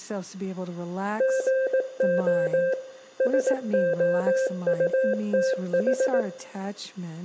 Morse code, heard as a keyed tone, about 18 wpm, 530 Hz, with room echo and speech in English. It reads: GO SOUTH